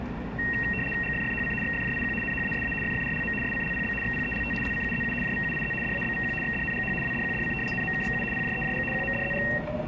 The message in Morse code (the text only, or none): none